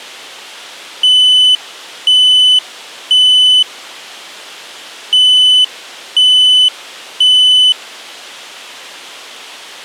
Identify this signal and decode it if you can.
Alarm pattern, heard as an alarm's beeps, played twice, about 3000 Hz. Temporal three. Smoke or fire, evacuate.